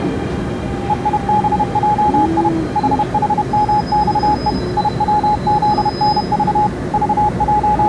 Morse code, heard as a keyed tone, machine-sent, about 31 wpm, 840 Hz, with the noise inside a subway train. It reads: EIBJI HHMXE IWZNV …